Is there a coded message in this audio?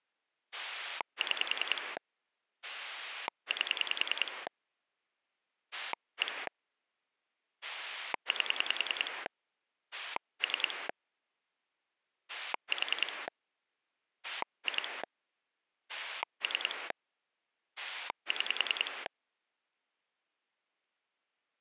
Yes: pulse dialling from 0.5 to 19.1 s, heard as a rotary dial, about 10 pulses a second. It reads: 6 8 1 8 3 4 2 3 6